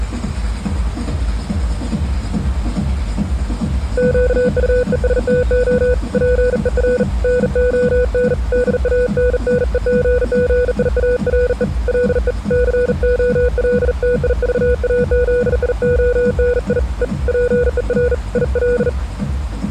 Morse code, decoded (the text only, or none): QUESTO PER NON DANNEGGIARE LE COLTIVAZIONI E PER IL